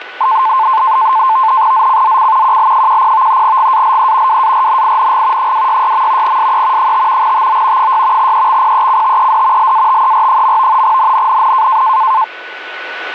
NAVTEX (SITOR-B), 100 baud, 170 Hz shift, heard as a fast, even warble, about 970 Hz centre, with radio static, static crashes and a steady whistle near 1490 Hz. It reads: ZCZC QL10 GALE WARNING 266. SE 5 TO 6 EXPECTED LATER. NNNN